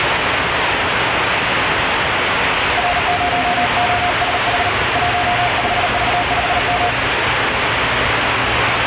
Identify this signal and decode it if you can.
Morse code, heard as a keyed tone, hand-sent with a paddle, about 38 wpm, 710 Hz, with heavy radio static and the noise of a subway station. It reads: R0OSH 15V5M